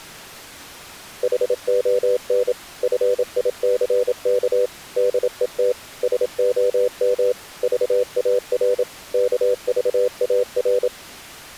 Morse code, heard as a keyed tone, machine-sent, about 27 wpm, 500 Hz. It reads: HON FICK DET SOM VAR KVAR